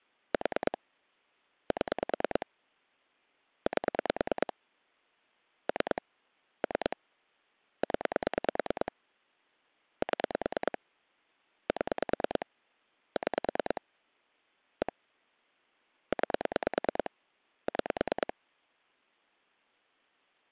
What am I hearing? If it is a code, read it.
Pulse dialling, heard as clicks on a phone line, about 9 pulses a second. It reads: 4 7 8 3 3 0 7 7 6 1 9 6